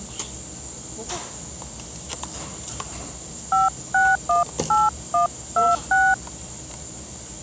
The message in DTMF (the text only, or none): 5618126